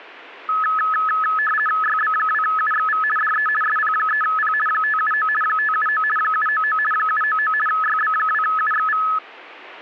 RTTY (50 baud, 450 Hz shift), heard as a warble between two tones, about 1500 Hz centre. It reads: YB2UXV DE SP3P 579 579 799 799 YB2UXV